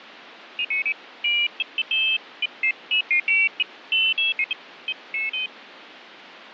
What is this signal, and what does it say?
Pairs of high tones at irregular times, with radio static. There is no code.